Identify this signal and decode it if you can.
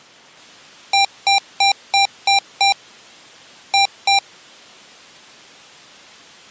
Beep code, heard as beeps from a small speaker, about 790 Hz. 6-2.